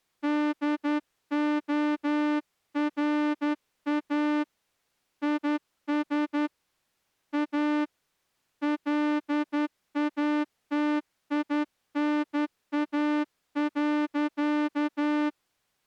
Morse code, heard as a horn, hand-sent with a straight key, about 11 wpm. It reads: DORA IS A LATINA.